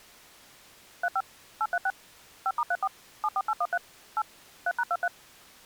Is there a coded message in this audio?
Yes: DTMF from 1.0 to 5.1 s, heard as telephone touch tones, dialled by machine, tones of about 50 ms. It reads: 35 836 5*34 74813 8 3#23